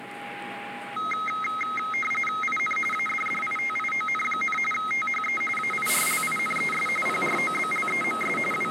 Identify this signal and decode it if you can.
RTTY (45.45 baud, 850 Hz shift), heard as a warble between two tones, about 1700 Hz centre, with radio static, a steady whistle near 820 Hz and the noise inside a bus. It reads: IN ADDITION, THE AIRLINES PROBLEMS …